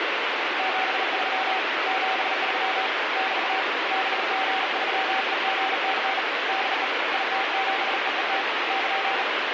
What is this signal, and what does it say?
Morse code, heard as a keyed tone, hand-sent with a bug key, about 38 wpm, 770 Hz, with heavy radio static. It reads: 73 73 <BT> BG3EGC DE IT7EET <KN>